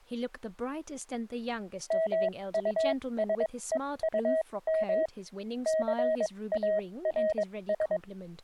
Morse code, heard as a keyed tone, machine-sent, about 22 wpm, spaced as for 18 wpm, 640 Hz, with speech in English. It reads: MUSEUM CARS